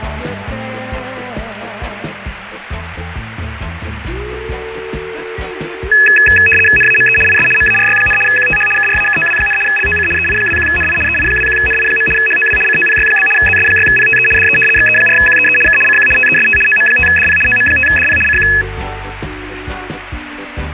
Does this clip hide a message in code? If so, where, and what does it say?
Yes: RTTY (75 baud, 850 Hz shift) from 5.9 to 18.6 s, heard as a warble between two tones, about 2150 Hz centre, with radio static. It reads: NAME IS MARY, QTH KRAKOW, LOC EI21NI EI21NI. HOW COPY? ZS6PTE DE XE4QEE K CQ TEST OM5DP OM5DP CQ